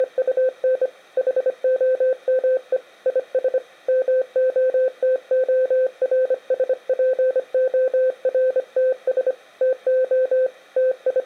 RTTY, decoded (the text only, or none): none